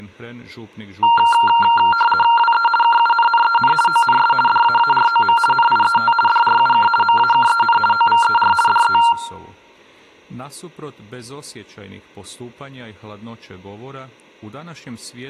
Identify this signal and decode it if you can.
RTTY (50 baud, 450 Hz shift), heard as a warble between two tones, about 1160 Hz centre, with speech in Croatian. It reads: WE KUNNEN ONS DAAROM NIET DRUK MAKEN OVER DE